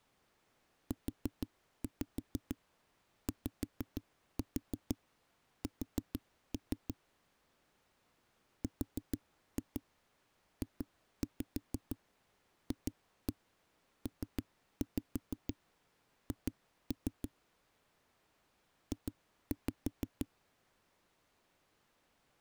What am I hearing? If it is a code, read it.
Tap code, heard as knocks on a wall, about 6 knocks a second. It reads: UYS RJFPH J